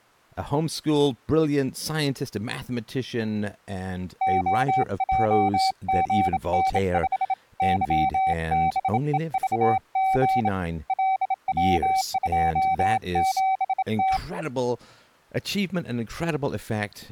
Morse code, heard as a keyed tone, hand-sent with a bug key, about 27 wpm, 760 Hz, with speech in English. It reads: OJGN5 YBEVG LW27T